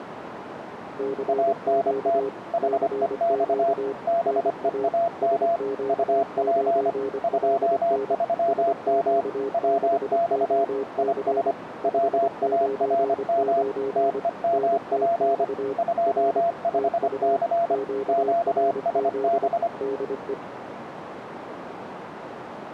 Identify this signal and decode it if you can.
Morse code, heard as two keyed tones, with radio static and a narrow filter. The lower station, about 25 wpm, 410 Hz: CQ CQ NA SQ9LN SQ6OC 599 NTX R TU QRZ DE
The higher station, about 25 wpm, 680 Hz: ANT HEX BEAM UP 23M WX IS WARM TEMP 25C QSB